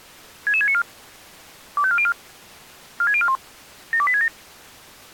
Five-tone selective call (ZVEI), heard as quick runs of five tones, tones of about 70 ms. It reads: 66694 25404 46041 72867